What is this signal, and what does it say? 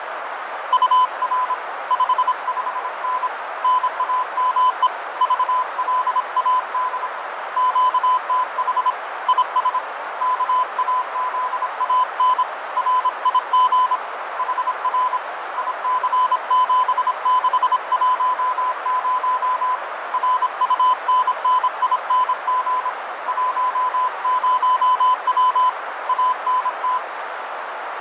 Morse code, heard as a keyed tone, hand-sent with a paddle, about 26 wpm, 1010 Hz, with heavy radio static, fading and a narrow filter. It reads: UR 55N NAME VLAD QTH IS KAZAN RIG HR IC7610 RUNNING 10W ANT